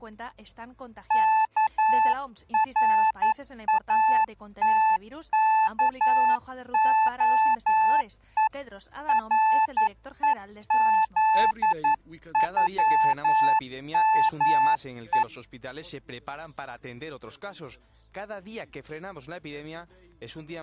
Morse code (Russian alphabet), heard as a keyed tone, hand-sent with a paddle, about 11 wpm, 880 Hz. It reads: КРАТКОЕ РЕЗЮМЕ